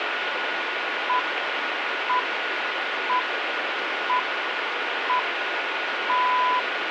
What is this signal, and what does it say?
Radio time signal (six pips, as the Greenwich Time Signal), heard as pips, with radio static and a steady whistle near 1450 Hz.